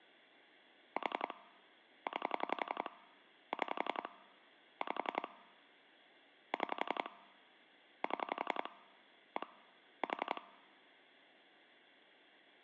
Pulse dialling, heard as clicks on a phone line, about 11 pulses a second. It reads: 4 9 6 5 6 7 1 4